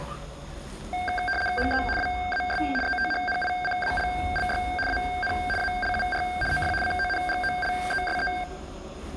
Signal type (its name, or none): RTTY